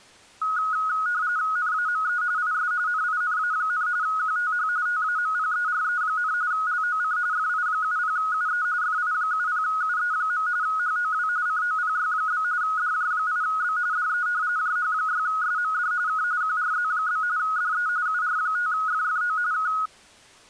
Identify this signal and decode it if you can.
RTTY (45.45 baud, 170 Hz shift), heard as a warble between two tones, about 1360 Hz centre. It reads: NAME IS NINA, QTH TAMPERE, LOC FI70UE FI70UE. HOW COPY? DJ8B DE JH6SMD K QRZ? DE UR5FFO K